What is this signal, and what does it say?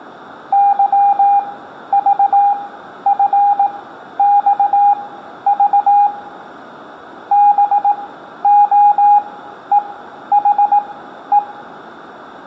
Morse code, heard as a keyed tone, machine-sent, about 18 wpm, spaced as for 11 wpm, 820 Hz, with room echo. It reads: YVFXV BOEHE